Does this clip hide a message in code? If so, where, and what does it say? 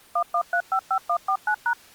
Yes: DTMF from 0.2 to 1.7 s, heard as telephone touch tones, dialled by machine, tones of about 80 ms. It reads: 11355149#